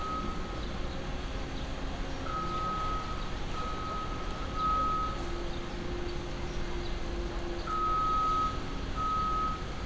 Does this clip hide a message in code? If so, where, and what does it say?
No, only street noise.